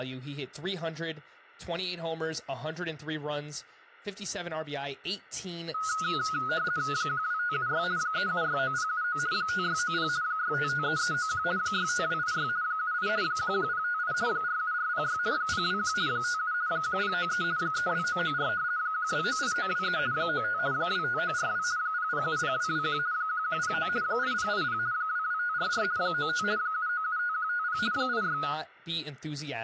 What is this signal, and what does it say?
RTTY (50 baud, 170 Hz shift), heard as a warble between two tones, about 1360 Hz centre, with speech in English. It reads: 12576 3769079 5690 6553391 65286 78 11058 47406 021 57 1093 32994 1298923 95 25942 0070221 1109 8080 22544 95 7975150 86